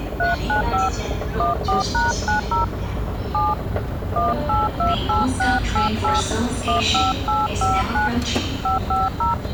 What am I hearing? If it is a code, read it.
DTMF, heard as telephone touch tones, dialled by hand, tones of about 160 ms, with the noise of a subway station. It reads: 395 14#90 7 1828688 15859 550